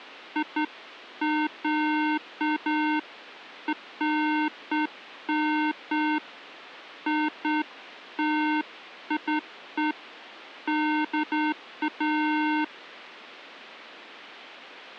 Beeps of irregular length. There is no code.